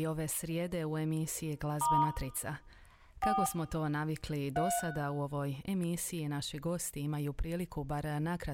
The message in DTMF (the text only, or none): * 4 3